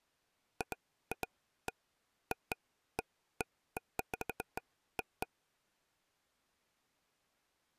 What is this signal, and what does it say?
Irregular taps on a table. There is no code.